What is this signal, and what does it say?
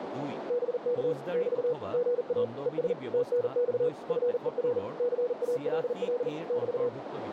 Morse code, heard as a keyed tone, machine-sent, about 40 wpm, 490 Hz, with radio static, a narrow filter and speech in Assamese. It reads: BK <BT> GA ES TNX FER CALL <BT>